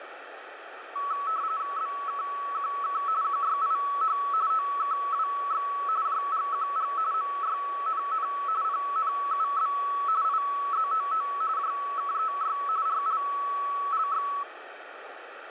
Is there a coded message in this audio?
Yes: RTTY (45.45 baud, 170 Hz shift) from 1.0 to 14.4 s, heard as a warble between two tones, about 1220 Hz centre, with radio static. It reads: BKQK QYIH OKWX JGQG MYNN PNUB IZOO JKEY RLLX